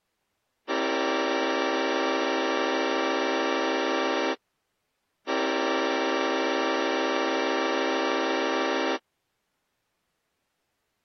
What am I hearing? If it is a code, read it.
Train horn signal, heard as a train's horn. 2 long. On North American railways: brakes released, proceed.